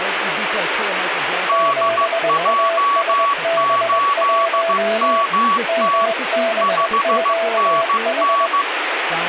Morse code, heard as two keyed tones, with radio static and speech in English. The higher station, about 15 wpm, 1130 Hz: DJ8MT 5NN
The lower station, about 21 wpm, 670 Hz: 7ASB1 MBQH